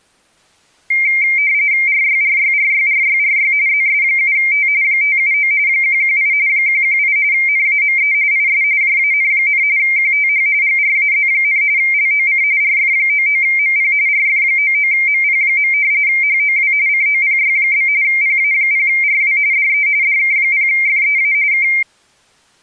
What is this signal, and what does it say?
RTTY (45.45 baud, 170 Hz shift), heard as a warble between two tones, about 2200 Hz centre. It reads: RYRYRYRYRY ZS7T 579 118 118 NAME IS JAN, QTH GRAZ, LOC RF99MP RF99MP. HOW COPY? PA0RW DE DK0FEA K